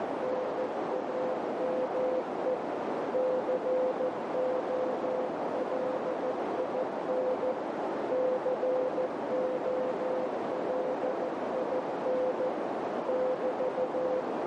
Morse code, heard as a keyed tone, machine-sent, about 14 wpm, 510 Hz, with heavy radio static and a narrow filter. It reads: NAME COLIN COLIN <BT>